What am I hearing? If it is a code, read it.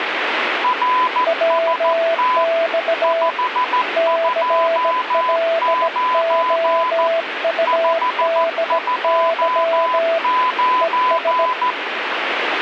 Morse code, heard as two keyed tones, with radio static. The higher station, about 14 wpm, 1010 Hz: RST 529 529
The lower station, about 17 wpm, 660 Hz: WX CLOUDY ES